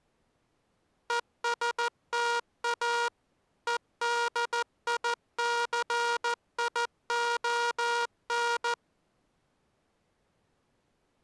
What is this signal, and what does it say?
Morse code, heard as a buzzer, machine-sent, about 14 wpm. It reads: ESTA EDICION